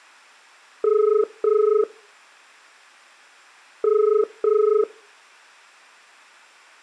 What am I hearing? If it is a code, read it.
Telephone call progress tone (as in the UK, Ireland, Australia and similar networks), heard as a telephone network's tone, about 430 Hz. Ringback tone.